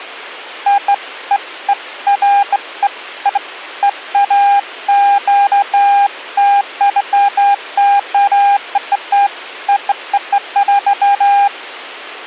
Beeps of irregular length. There is no code.